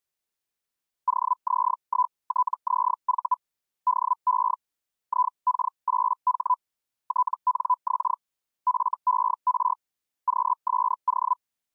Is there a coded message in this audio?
Yes: Hellschreiber (Feld-Hell, 122.5 baud) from 1.1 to 11.3 s, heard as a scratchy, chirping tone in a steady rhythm, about 1000 Hz. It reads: OZ1TZV DE IK8H TNX FER QSO